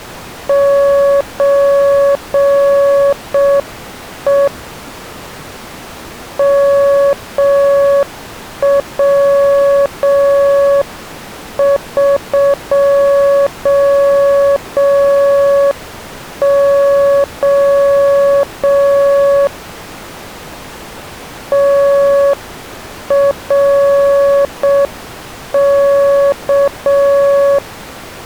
Morse code (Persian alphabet), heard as a keyed tone, hand-sent with a straight key, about 6 wpm, 560 Hz. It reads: چه موقع ترک